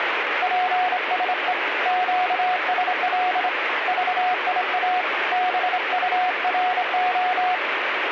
Morse code, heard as a keyed tone, hand-sent with a straight key, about 26 wpm, 730 Hz, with radio static. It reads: PSE QSL VIA BURO